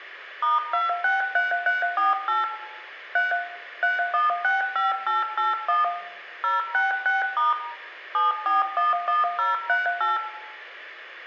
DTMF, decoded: *263348 3 3165881 066* 7411038

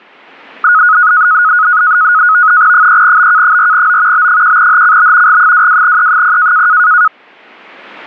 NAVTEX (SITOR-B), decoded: 3BK4O B1HCB G22E0

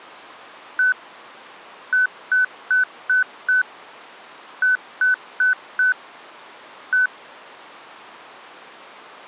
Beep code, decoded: 1-5-4-1

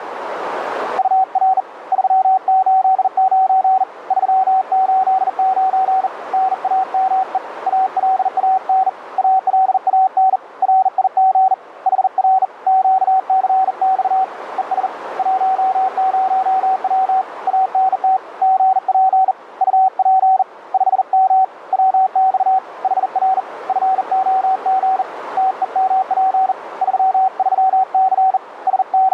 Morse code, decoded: UR 389 389 NAME ALAN ALAN RIG HR QCX ES 10W ANT GP UP 5M WX HR FOG TEMP 33C …

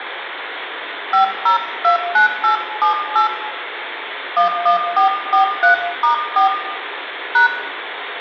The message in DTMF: 5029878 11443*4 #

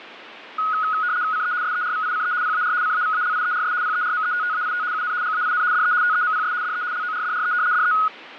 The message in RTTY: CE SERVICE PAR CAVALIERS PERMETTAIT UN GAIN DE TEMPS DE LORDRE DE

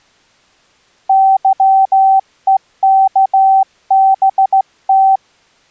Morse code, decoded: YEKBT

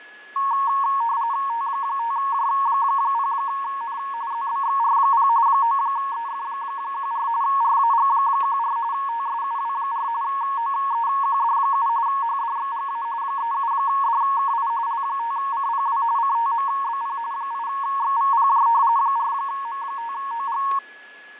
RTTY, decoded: T5J0N ZBXR0 9EF14 RAG14 TSUW4 OEQD7 HDXGA 37DKI L5CPW CTMBP 8XVPJ 4M5OG

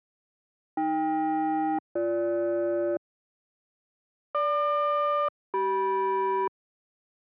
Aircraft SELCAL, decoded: AK-BG GQ-CM

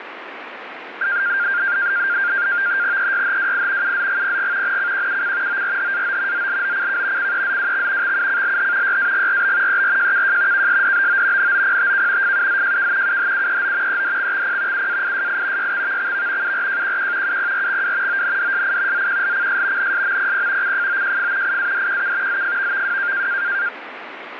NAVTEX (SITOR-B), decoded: EYHWI UZGPG NCQUC ORHAO ZLOCK CEZWX XUCLH YAGRB ERJKJ KSDBO NOPTK FUZJK UHUEO EDXXP UAISI YXVXV URJQQ UPRXW ONDSI ZQLCS NSMPP CFOJF IADQK ZFVVW

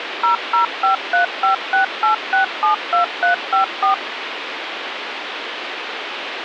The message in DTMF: 0053568672354

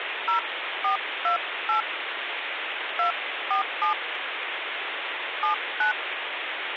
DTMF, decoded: 0428 247 79

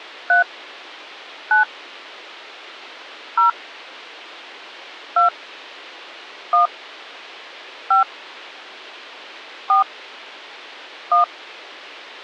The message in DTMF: 3 9 0 2 1 5 4 1

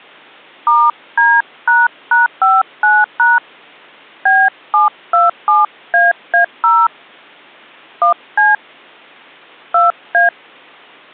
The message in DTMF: *D##59# B727AA0 1C 2A

